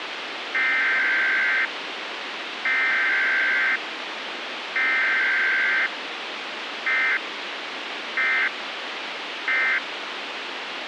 Emergency Alert System (SAME) tones (header bursts, then end-of-message bursts), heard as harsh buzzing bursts, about 520.83 baud, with radio hiss.